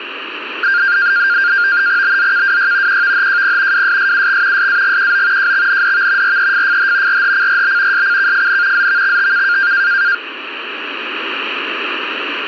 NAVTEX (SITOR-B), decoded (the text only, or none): BZKWY QVHJP WSSUX SAGQO JXNDV REFFH RHCRB SCKFN ZVXTK